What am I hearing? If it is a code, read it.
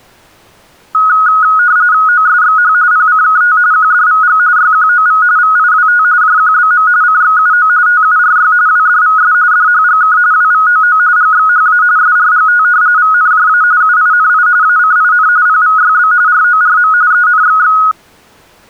RTTY (45.45 baud, 170 Hz shift), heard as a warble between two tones, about 1360 Hz centre. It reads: OSXH PCKT QDVG YQOV VIWT JQBM CXUO TURY WDVS DHGK WVOO GXHA SRGT VNJA UINI ACIN PVYB RORM ENXX